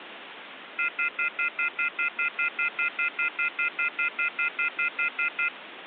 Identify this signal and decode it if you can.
Telephone call progress tone (North American plan), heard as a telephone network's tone, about 1400, 2050, 2450, 2600 Hz, 0.1 s on and 0.1 s off, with phone line noise. Off-hook warning tone.